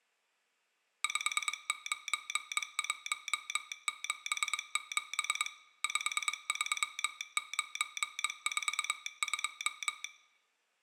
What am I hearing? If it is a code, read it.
Morse code, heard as a telegraph sounder, machine-sent, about 22 wpm, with room echo. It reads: 59177 53942